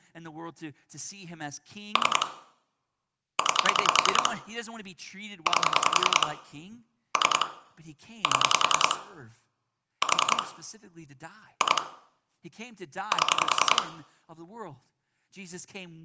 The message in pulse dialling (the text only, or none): 3 9 8 3 7 4 2 7